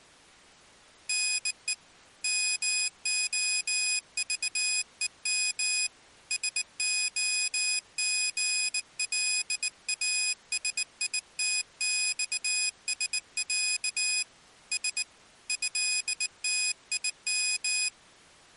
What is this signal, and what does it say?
Morse code (Russian alphabet), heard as a high beeper, hand-sent with a bug key, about 19 wpm, 2500 Hz. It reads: НЕ МОЖЕМ СОГЛАСИТЬСЯ С ЭТИМ